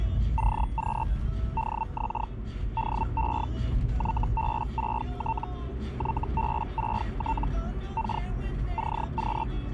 Hellschreiber (Feld-Hell, 122.5 baud), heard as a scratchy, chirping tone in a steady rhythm, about 900 Hz, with the noise inside a car. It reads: CQ DX DE YB6T YB6T K CQ